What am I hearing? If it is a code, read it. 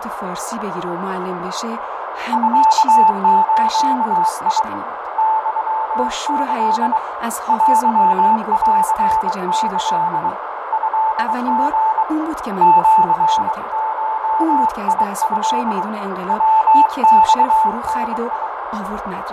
Morse code (Japanese Wabun code), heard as a keyed tone, hand-sent with a bug key, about 23 wpm, 880 Hz, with heavy radio static, fading, a narrow filter and speech in Persian. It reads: ミズ ユキ テンキ トリ シゴト ヤマダ